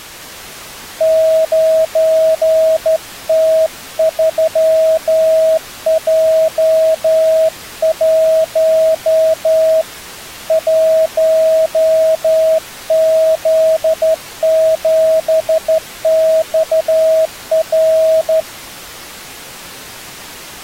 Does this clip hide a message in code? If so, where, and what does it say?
Yes: Morse code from 0.9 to 18.5 s, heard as a keyed tone, hand-sent with a straight key, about 12 wpm, 640 Hz. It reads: 9T3J1 1Z7XR